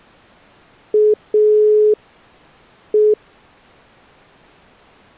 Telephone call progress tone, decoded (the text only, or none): dial tone